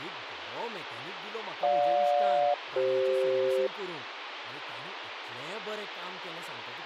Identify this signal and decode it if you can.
Aircraft SELCAL, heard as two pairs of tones, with radio hiss and speech in Goan Konkani. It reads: GJ-CF